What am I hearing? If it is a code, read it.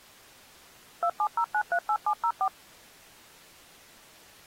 DTMF, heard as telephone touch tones, dialled by machine, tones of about 70 ms. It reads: 270938704